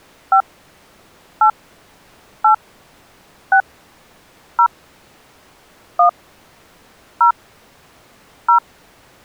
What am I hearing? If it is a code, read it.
DTMF, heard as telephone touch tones, dialled by hand, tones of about 90 ms. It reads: 5 8 8 6 0 1 0 0